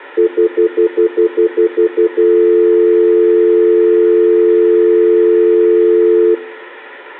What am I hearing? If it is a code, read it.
Telephone call progress tone (North American plan), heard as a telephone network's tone, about 350, 440 Hz, 0.1 s on and 0.1 s off, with room echo. Stutter dial tone.